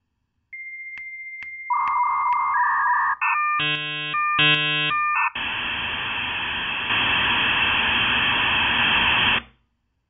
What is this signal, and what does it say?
Dial-up modem handshake (V.34 or later), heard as a whistle, warbles, then hiss.